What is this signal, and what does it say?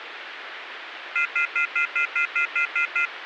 Telephone call progress tone (North American plan), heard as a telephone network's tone, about 1400, 2050, 2450, 2600 Hz, 0.1 s on and 0.1 s off, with phone line noise. Off-hook warning tone.